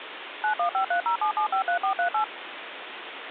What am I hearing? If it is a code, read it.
DTMF, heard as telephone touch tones, dialled by machine, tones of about 100 ms, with phone line noise. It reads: 915307753438